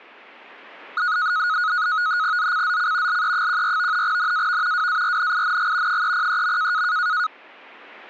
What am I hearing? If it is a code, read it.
NAVTEX (SITOR-B), 100 baud, 170 Hz shift, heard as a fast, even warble, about 1360 Hz centre. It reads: ZCZC LE14 NAV WARNING 303.